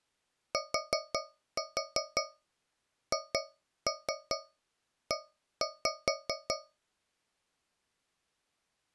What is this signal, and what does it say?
Tap code, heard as taps on a metal pipe, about 5 knocks a second. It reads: THE